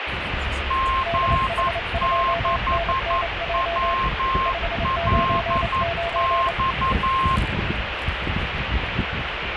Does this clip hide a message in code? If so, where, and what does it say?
Yes: Morse code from 0.6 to 7.4 s, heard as two keyed tones, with radio static and the noise inside a car. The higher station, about 11 wpm, 1060 Hz: G6WLX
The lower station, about 28 wpm, 680 Hz: DH2NNJ 599